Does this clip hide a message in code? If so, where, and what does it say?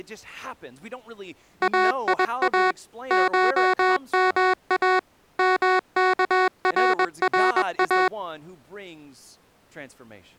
Yes: Morse code (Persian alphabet) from 1.6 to 8.1 s, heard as electronic beeps, machine-sent, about 21 wpm, 370 Hz, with speech in English. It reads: ایا شما مکررا